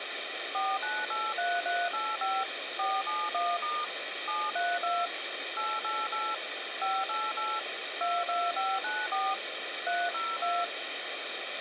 DTMF, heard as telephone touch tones, dialled by machine, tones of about 220 ms, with phone line noise. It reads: 4983385 471* 732 888 588 22594 302